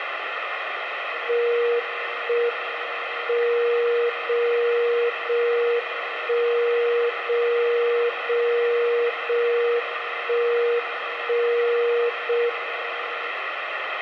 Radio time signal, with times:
1.3-2.3 1
2.3-3.3 M
3.3-4.3 0
4.3-5.3 0
5.3-6.3 1
6.3-7.3 0
7.3-8.3 0
8.3-9.3 0
9.3-10.3 1
10.3-11.3 1
11.3-12.3 0
12.3-13.3 M

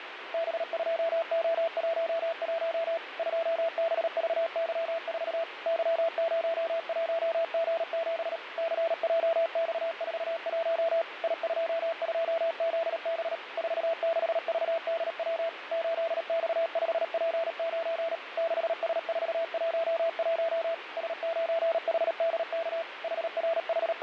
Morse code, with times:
0.3-3.0 B2O11
3.2-5.4 2BVY4
5.7-8.4 Y01G7
8.6-11.0 CJX41
11.2-13.4 I22ZB
13.6-15.5 46VDW
15.7-18.2 8X5P9
18.4-20.7 6S411
21.0-22.8 S9HDK
23.0-24.0 …

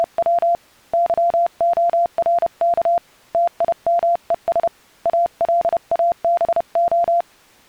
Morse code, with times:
0.0-0.5 …
0.9-3.0 YORK
3.3-4.7 TIMES
5.1-7.2 ALABO

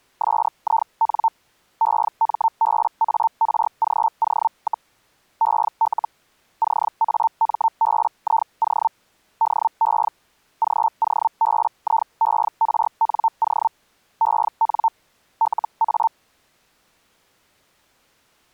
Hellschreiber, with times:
0.2-1.3 SIN
1.8-4.9 EMBARGO,
5.4-6.1 EL
6.6-8.9 CAMBIO
9.4-10.1 DE
10.6-13.7 GOBIERNO
14.2-14.9 EN
15.4-16.1 LA

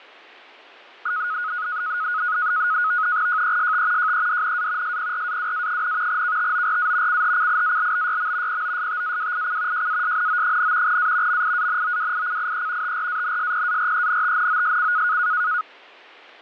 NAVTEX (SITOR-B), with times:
3.3-4.1 JEST
4.0-5.0 JEDNA
4.8-6.2 SPRAWA,
6.1-7.2 KTORA
7.1-8.6 CHCIALBYM
8.5-9.9 POSTAWIC
9.7-11.0 JASNO,
10.9-11.4 A
11.3-13.0 MIANOWICIE
12.8-15.2 TRANSPARENTNOSC

